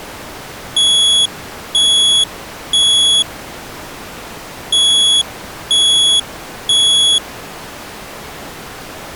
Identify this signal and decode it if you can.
Alarm pattern, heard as an alarm's beeps, played twice, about 3350 Hz. Temporal three. Smoke or fire, evacuate.